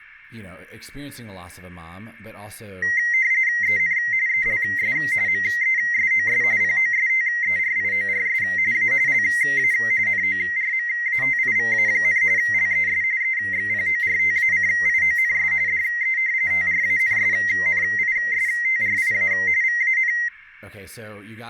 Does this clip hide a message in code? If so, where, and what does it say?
Yes: RTTY (45.45 baud, 170 Hz shift) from 2.8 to 20.3 s, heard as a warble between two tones, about 2000 Hz centre, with speech in English. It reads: EN ELS MESOS POSTERIORS A LA NORMATIVA, LES EXPORTACIONS DE TRANSNISTRIA VAN